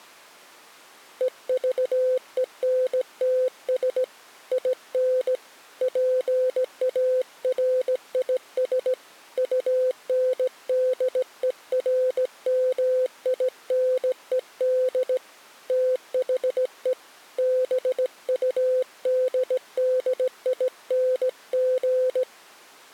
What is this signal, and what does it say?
Morse code, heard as a keyed tone, hand-sent with a straight key, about 17 wpm, 510 Hz. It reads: EVENTS IN PARIS UNDERMINED THE BUDDING